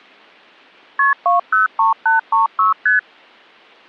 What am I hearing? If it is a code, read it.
Multi-frequency trunk signalling (R1, as on North American trunks), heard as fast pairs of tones, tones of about 140 ms. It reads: KP 203836 ST